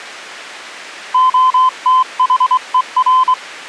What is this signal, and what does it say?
Morse code, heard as a keyed tone, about 23 wpm, 1030 Hz. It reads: OTHER